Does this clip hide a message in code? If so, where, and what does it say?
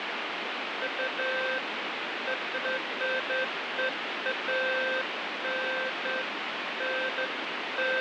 No, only beeps of irregular length, with radio static.